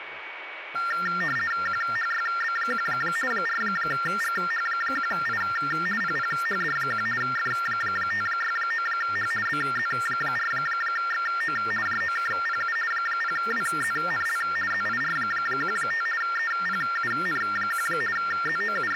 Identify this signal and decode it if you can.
RTTY (50 baud, 450 Hz shift), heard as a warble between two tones, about 1600 Hz centre, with radio static, a steady whistle near 2250 Hz and speech in Italian. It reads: QHYB1 4GH1I PPHD1 F569H BZ4XO JOKPU 0WZNL ZIR15 EPUN1 …